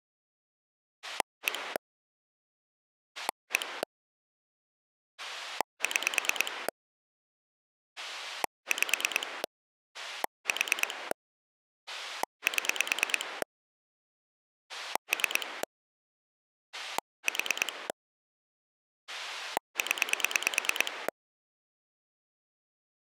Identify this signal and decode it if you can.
Pulse dialling, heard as a rotary dial, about 9 pulses a second. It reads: 1 1 6 5 4 7 3 4 0